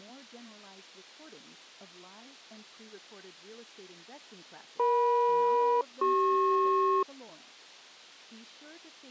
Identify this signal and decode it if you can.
Aircraft SELCAL, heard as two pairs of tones, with speech in English. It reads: EM-CP